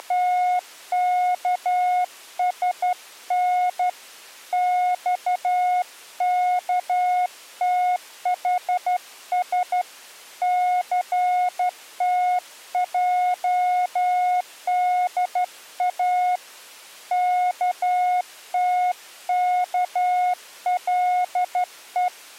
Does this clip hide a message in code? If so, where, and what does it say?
Yes: Morse code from 0.0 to 22.1 s, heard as a keyed tone, hand-sent with a straight key, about 12 wpm, 720 Hz. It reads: … XKTHS CTJDA KTKLE